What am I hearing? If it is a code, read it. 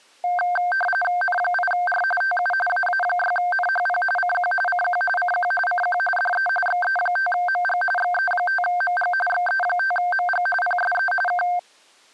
RTTY (45.45 baud, 850 Hz shift), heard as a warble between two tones, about 1140 Hz centre. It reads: N8R TU AA6NHP CQ CQ CQ CQ DE XE5MG XE5MG XE5MG PSE K